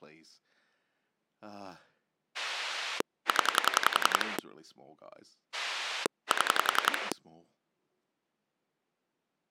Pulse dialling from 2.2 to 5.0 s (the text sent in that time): 0